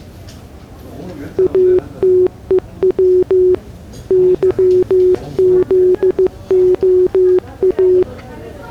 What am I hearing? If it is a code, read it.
Morse code, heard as a keyed tone, machine-sent, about 15 wpm, 370 Hz, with the noise of a crowd indoors. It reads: ATEW YZOA